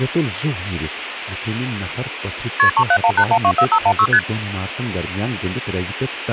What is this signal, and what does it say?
Multi-frequency trunk signalling (R1, as on North American trunks), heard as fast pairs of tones, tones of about 70 ms, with phone line noise and speech in Kashmiri. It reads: KP 3718124516 ST